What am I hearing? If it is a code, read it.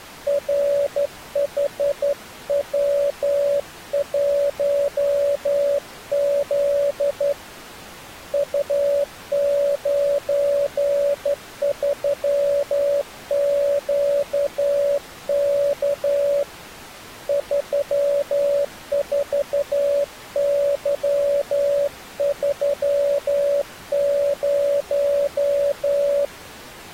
Morse code, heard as a keyed tone, hand-sent with a straight key, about 12 wpm, 570 Hz. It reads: RHW1Z U93QK 34Y30